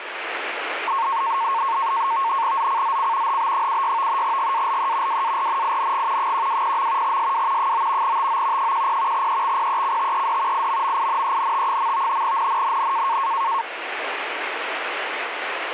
NAVTEX (SITOR-B), 100 baud, 170 Hz shift, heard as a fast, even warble, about 1000 Hz centre, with radio static. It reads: ZCZC HB76 GALE WARNING 120. SW 9 TO 10 EXPECTED IMMINENT. NNNN